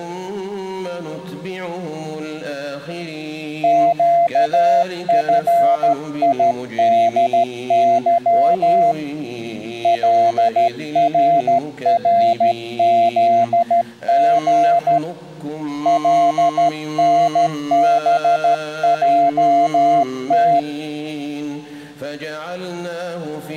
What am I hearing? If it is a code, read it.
Morse code, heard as a keyed tone, hand-sent with a straight key, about 13 wpm, 690 Hz. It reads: QFIDY LRRZG LNBJT